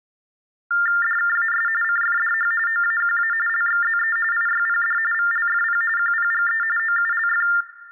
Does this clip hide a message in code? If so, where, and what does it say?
Yes: TTY/TDD text telephone tones (45.45 baud Baudot) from 0.7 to 7.6 s, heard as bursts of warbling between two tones, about 400 Hz shift, 1600 Hz centre, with room echo. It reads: DKAS CFDH OAQA LXZE IYPD VLFP QPGE OULF